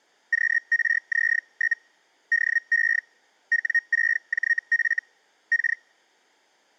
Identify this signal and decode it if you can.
Hellschreiber (Feld-Hell, 122.5 baud), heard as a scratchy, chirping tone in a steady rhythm, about 1850 Hz. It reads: QRZ? DE W6JF K